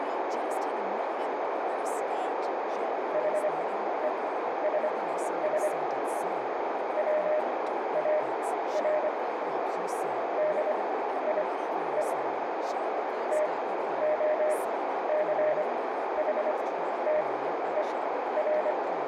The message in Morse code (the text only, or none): HESS WAR DIE TOCHTER